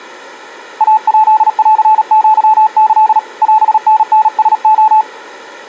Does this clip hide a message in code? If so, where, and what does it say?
Yes: Morse code (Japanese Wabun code) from 0.7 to 5.1 s, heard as a keyed tone, hand-sent with a paddle, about 37 wpm, 870 Hz. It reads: イヱンアキ オタタラレ